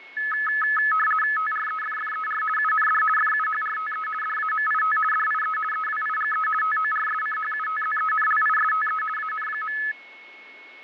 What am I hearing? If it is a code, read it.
RTTY (50 baud, 450 Hz shift), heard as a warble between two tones, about 1500 Hz centre, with fading and a steady whistle near 2190 Hz. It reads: TREFFER UND FUHRTE DAMIT DIE EWIGE TORSCHUTZENLISTE AN.